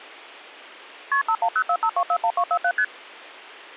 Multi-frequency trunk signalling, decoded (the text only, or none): KP 51045241247 ST